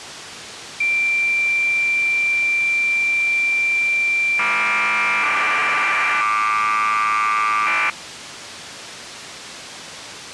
Cassette data (Kansas City type), 1200 baud, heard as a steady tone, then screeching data.